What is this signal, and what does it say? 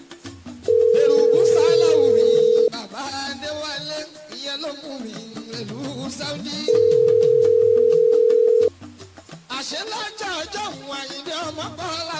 Telephone call progress tone (North American plan), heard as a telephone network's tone, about 440, 480 Hz, 2 s on and 4 s off. Ringback tone.